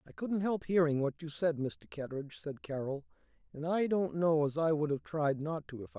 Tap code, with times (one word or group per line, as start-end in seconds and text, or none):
none